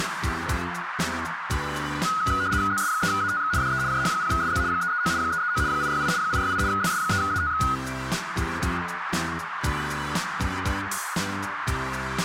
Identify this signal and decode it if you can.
RTTY (75 baud, 170 Hz shift), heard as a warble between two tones, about 1360 Hz centre, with radio static and a narrow filter. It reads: ZS3ATX DE JH0SZ 339 339 868 868 ZS3ATX